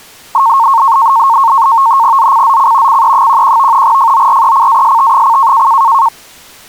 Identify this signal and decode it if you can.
NAVTEX (SITOR-B), 100 baud, 170 Hz shift, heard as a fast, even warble, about 1000 Hz centre. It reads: ZCZC CE11 FORECAST: